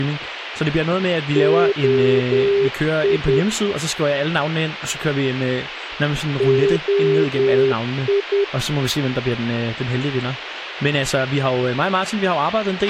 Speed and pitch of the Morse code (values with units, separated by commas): 10 wpm, 400 Hz